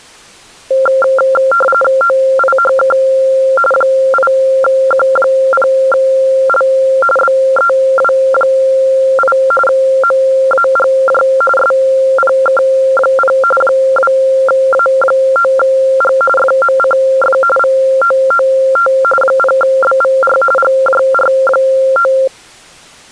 RTTY (45.45 baud, 850 Hz shift), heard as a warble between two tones, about 960 Hz centre. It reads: OIHK 8Q0L BEW8 MAGJ SPK0 2A9G FMCF VOOT 0BVR GJR9